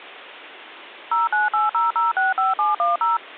DTMF, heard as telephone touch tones, dialled by machine, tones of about 160 ms. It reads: 0980065710